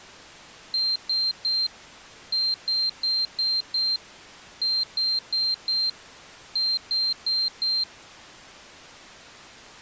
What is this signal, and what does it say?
Beep code, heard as a piezo beeper, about 4150 Hz. 3-5-4-4.